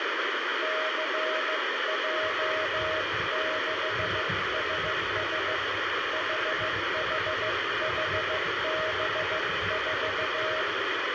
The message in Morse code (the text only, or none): CJ6SS HHHB4